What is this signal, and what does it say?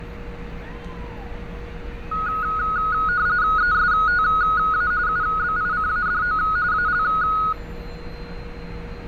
RTTY (45.45 baud, 170 Hz shift), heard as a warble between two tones, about 1360 Hz centre, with fading and street noise. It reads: ESTA UBICADO AL